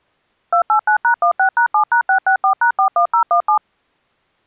DTMF, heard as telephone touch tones, dialled by machine, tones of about 100 ms. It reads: 289#16#7#664#41017